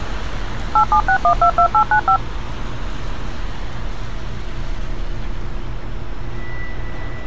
DTMF, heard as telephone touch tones, dialled by machine, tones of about 80 ms, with street noise. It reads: 876122895